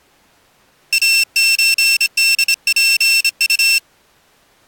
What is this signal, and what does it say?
Morse code (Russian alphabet), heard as a high beeper, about 26 wpm, 2700 Hz. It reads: АЧДПУ